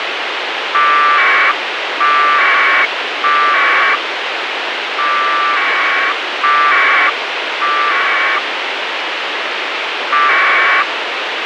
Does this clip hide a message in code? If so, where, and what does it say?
Yes: packet radio (AX.25, as in APRS), 1200 baud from 0.7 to 10.8 s, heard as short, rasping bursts, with radio hiss and a squelch burst at the end.